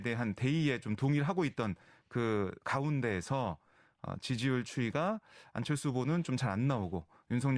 Speech in Korean. There is no code.